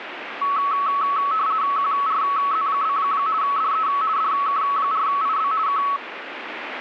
RTTY (50 baud, 170 Hz shift), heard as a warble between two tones, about 1210 Hz centre, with radio static. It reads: QRZ? DE DK4IB K